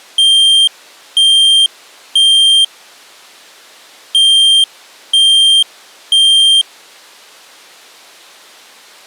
Alarm pattern, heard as an alarm's beeps, played twice, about 3200 Hz. Temporal three. Smoke or fire, evacuate.